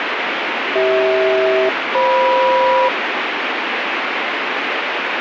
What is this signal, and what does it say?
Aircraft SELCAL, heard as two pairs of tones, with radio static. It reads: CH-FM